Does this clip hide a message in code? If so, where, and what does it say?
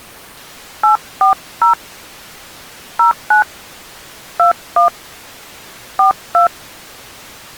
Yes: DTMF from 0.8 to 6.5 s, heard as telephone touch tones, dialled by hand, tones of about 120 ms. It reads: 840 09 21 42